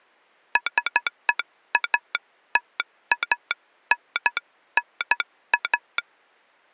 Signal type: Morse code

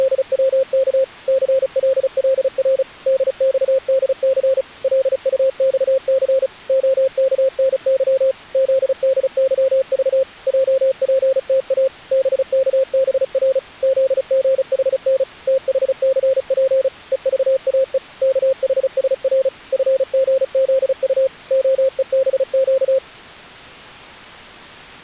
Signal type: Morse code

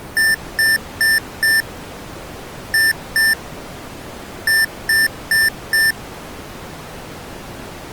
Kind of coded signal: beep code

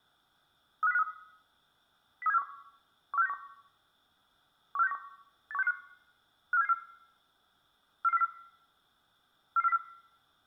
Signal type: five-tone selective call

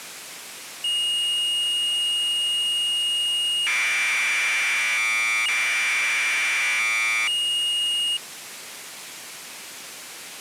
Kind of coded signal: Commodore tape loading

